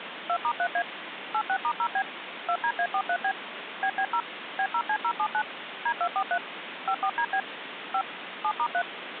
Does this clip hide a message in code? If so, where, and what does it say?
Yes: DTMF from 0.3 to 8.8 s, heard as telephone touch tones, dialled by machine, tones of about 70 ms, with phone line noise. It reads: 2*3A 86*0B 2DA43B BB0 B0C079 D243 54DB 5 7*3